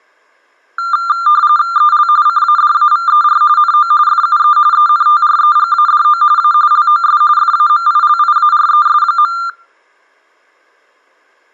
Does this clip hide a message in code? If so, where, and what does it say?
Yes: RTTY (45.45 baud, 170 Hz shift) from 0.8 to 9.5 s, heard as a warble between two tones, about 1290 Hz centre, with room echo. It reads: EL CADAVER NO FUE ENTREGADO A LOS FAMILIARES.